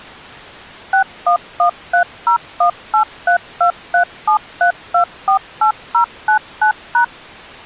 DTMF, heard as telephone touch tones, dialled by machine, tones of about 100 ms. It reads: 611301832373248099#